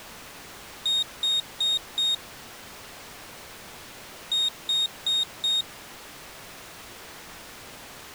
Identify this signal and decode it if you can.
Beep code, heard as a piezo beeper, played twice, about 3700 Hz. 4 short. In AMI BIOS tables: system timer failure; in Dell tables: memory read or write failure.